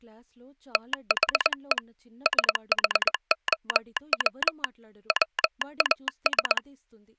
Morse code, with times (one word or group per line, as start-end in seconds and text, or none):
0.8-1.8 THE
2.3-4.6 SHOW
5.1-6.6 WAS